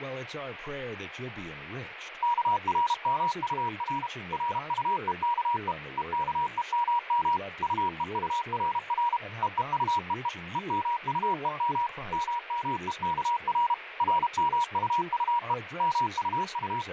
Morse code, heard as a keyed tone, machine-sent, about 32 wpm, 960 Hz, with radio static, fading and speech in English. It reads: KRMUR RUEKE EKEMM UEURR EEUEE EMUEM MMEKR RMUUE …